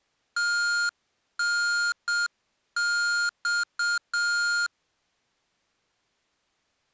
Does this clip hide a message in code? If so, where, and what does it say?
Yes: Morse code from 0.3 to 4.7 s, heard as electronic beeps, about 7 wpm, 1410 Hz. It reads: TNX